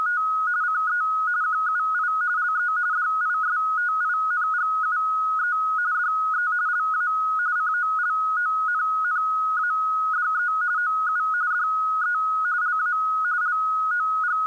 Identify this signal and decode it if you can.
RTTY (45.45 baud, 170 Hz shift), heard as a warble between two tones, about 1360 Hz centre. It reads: … CE QUI LE DISTINGUE DE LA COLONNADE OU DE LA …